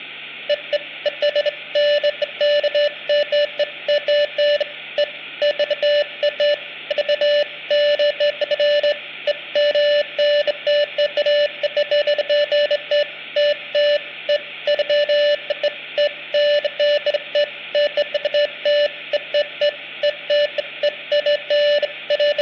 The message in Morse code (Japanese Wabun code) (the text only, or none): none